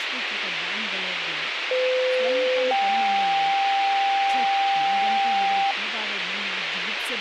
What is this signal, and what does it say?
Two-tone page, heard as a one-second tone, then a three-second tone, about 510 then 790 Hz, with radio hiss, a squelch burst at the end and speech in Kannada.